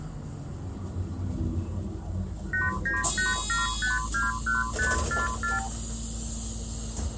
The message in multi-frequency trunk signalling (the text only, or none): 8987521544